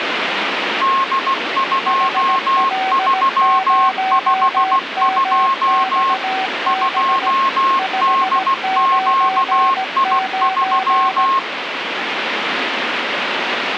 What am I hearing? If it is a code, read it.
Morse code, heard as two keyed tones, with radio static. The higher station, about 16 wpm, 1080 Hz: D2352 2DQI3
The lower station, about 17 wpm, 760 Hz: HL0MXB 599